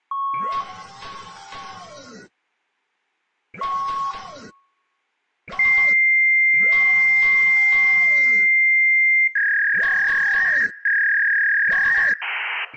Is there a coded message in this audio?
Yes: fax machine handshake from 0.1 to 12.7 s, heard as beeps, a long tone, a warble and hiss, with room echo.